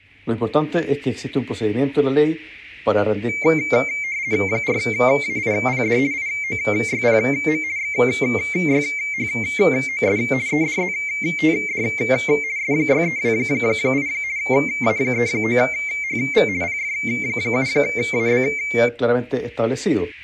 RTTY (50 baud, 170 Hz shift), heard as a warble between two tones, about 2200 Hz centre. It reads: 4AIPD IOYPM XYHOS EDZTD S6328 A39HV PF7AB